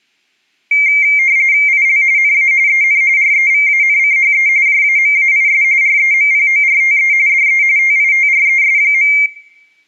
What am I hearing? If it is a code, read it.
RTTY (45.45 baud, 170 Hz shift), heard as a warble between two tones, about 2200 Hz centre, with room echo. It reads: IL NA EN REVANCHE JAMAIS REMPORTE DE TITRES.